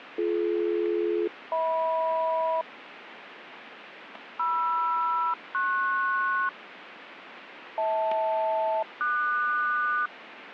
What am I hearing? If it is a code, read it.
Aircraft SELCAL, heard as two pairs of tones, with radio static. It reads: BD-HM MR-PS HL-QS